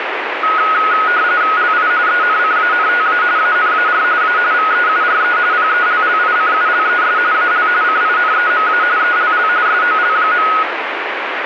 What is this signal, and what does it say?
RTTY (45.45 baud, 170 Hz shift), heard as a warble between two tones, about 1360 Hz centre, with radio static. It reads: LI ENCANTA ANAR A VEURE PELLICULES AL CINEMA ELL SOL.